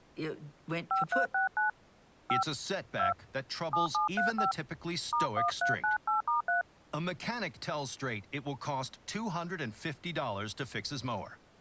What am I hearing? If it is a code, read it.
DTMF, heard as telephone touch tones, dialled by hand, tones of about 130 ms, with speech in English. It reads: 5369 5 2 7735 *1398*3